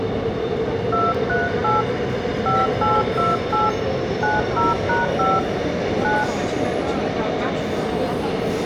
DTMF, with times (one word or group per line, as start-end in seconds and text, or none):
0.9-1.8 238
2.5-3.7 5828
4.2-5.4 90#5
6.0-6.2 9